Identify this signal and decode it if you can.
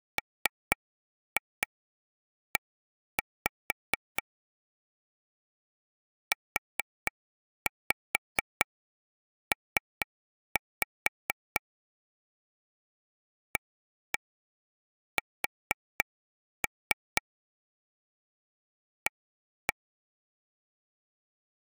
Tap code, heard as taps on a table, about 4 knocks a second. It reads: ME UP AS A